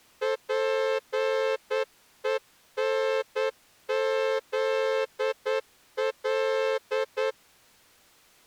Morse code, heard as a horn, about 9 wpm. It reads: PENZL